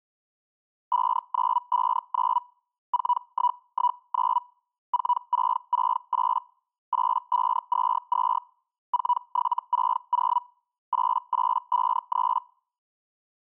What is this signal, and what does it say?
Hellschreiber (Feld-Hell, 122.5 baud), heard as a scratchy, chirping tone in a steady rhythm, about 980 Hz. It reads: 5959 4119 4668 8522 4760 8853